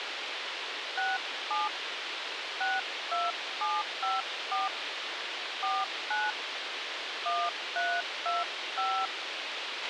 DTMF, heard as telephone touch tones, dialled by hand, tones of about 220 ms, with radio hiss and a squelch burst at the end. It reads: 67 62754 49 1325